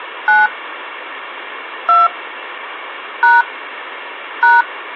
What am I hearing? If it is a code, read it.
DTMF, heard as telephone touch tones, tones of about 180 ms. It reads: 9 2 # #